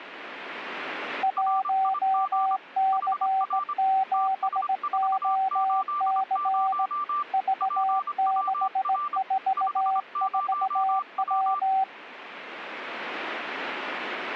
Morse code, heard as two keyed tones. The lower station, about 18 wpm, 770 Hz: 1C7OC V644W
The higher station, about 25 wpm, 1180 Hz: RIG HR TS480 PWR 50W